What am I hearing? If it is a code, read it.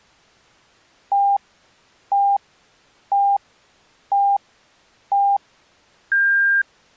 Radio time signal (five pips and a higher one, as on Chinese radio), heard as pips.